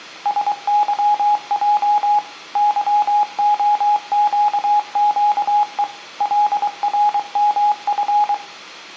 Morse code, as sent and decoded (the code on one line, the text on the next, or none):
... -.-- .--- / -.-- --- --.- --.- . / .-.. .-. -- ..-.
SYJ YOQQE LRMF